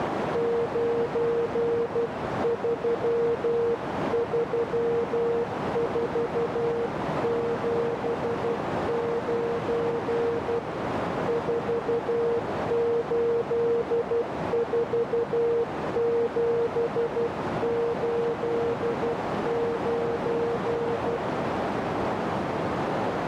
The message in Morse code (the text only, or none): 933479 484789